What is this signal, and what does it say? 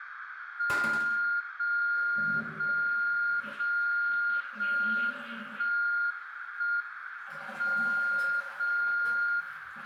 Radio time signal (JJY), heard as a tone whose level steps once a second, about 1410 Hz, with radio static, a narrow filter, room echo and the noise of a restroom. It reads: 0 0 0 0 1 1 M 0 0